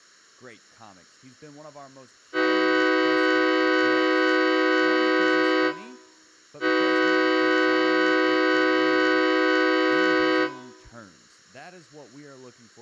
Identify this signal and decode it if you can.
Train horn signal, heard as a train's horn, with speech in English. 2 long. On North American railways: brakes released, proceed.